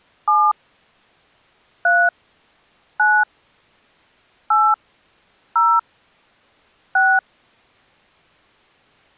DTMF, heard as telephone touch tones, dialled by hand, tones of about 240 ms. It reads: 7 3 9 8 0 6